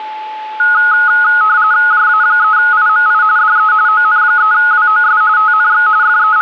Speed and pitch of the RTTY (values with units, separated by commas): 45.45 baud, 170 Hz shift, 1360 Hz centre